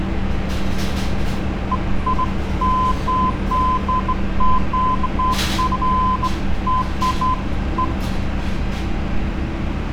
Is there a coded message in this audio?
No, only beeps of irregular length, with street noise.